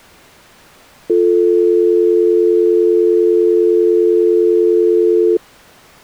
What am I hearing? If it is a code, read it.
Telephone call progress tone (North American or UK plan), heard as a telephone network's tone, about 350, 440 Hz. Dial tone.